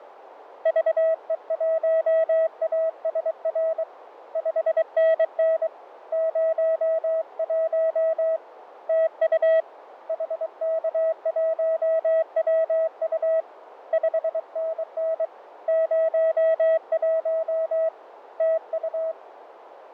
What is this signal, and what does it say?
Morse code, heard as a keyed tone, hand-sent with a paddle, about 23 wpm, 650 Hz, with radio static and fading. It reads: VE1ASR 5NN 01 TU HK1WU 5NN 01 TU